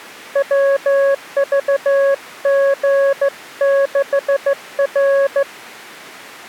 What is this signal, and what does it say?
Morse code, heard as a keyed tone, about 15 wpm, 550 Hz. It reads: WVG6R